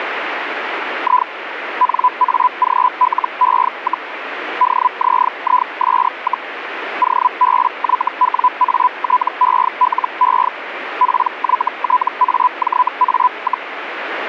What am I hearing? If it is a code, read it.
Hellschreiber (Feld-Hell, 122.5 baud), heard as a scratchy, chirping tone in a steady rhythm, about 1000 Hz, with radio static. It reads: I NAGLE, DZIS, OBYWATELE PYTAJA,